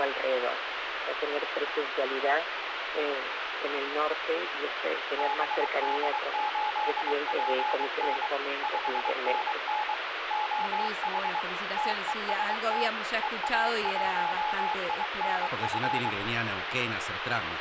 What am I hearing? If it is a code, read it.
Morse code, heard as a keyed tone, machine-sent, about 23 wpm, 850 Hz, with radio static. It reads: BD8PN 5NN OH TEST EA1INF